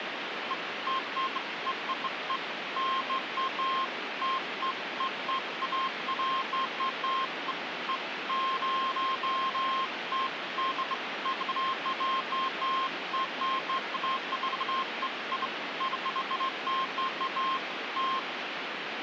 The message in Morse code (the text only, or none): none